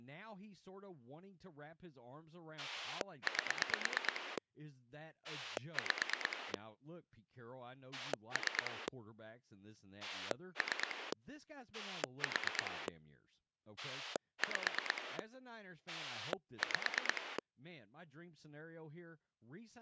Pulse dialling, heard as a rotary dial, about 9 pulses a second, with speech in English. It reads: 8 5 3 3 4 5 5